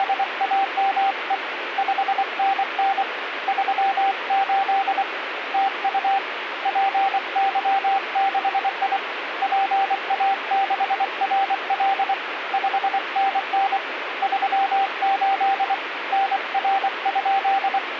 Morse code, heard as a keyed tone, hand-sent with a paddle, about 24 wpm, 780 Hz, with radio static. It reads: … 5NN 38 TU PY6I PA6RL 5NN 38 NR?